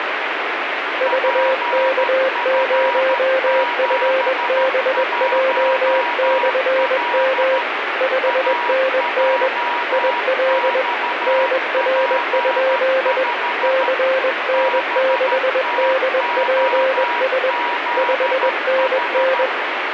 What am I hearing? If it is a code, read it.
Morse code, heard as two keyed tones, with radio static. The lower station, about 21 wpm, 530 Hz: VK0FBJ/M 5NN IL NR? CN6DPS 5NN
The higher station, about 13 wpm, 960 Hz: PF71L AJXP5 BTOZH